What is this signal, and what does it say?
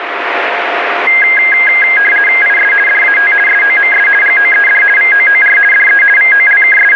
RTTY (50 baud, 450 Hz shift), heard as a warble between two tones, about 1850 Hz centre, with radio static. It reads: IS DAT SOMS GOED VOOR DE …